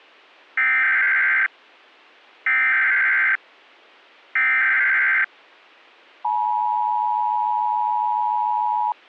Emergency Alert System (SAME) tones (header bursts, then the 853 and 960 Hz attention tone), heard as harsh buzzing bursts, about 520.83 baud.